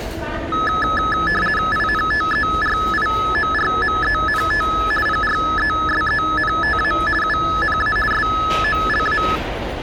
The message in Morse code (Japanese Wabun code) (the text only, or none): none